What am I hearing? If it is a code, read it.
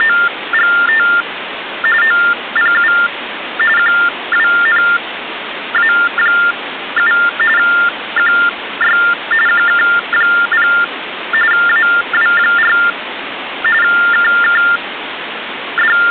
TTY/TDD text telephone tones (45.45 baud Baudot), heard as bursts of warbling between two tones, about 400 Hz shift, 1600 Hz centre, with phone line noise. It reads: … OPU QWNA7 QY QK0 AW4 …